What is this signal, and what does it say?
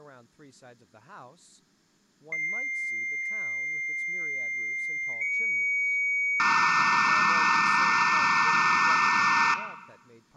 Dial-up modem handshake (low-speed, two carriers), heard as two whistles, then hiss, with room echo and speech in English.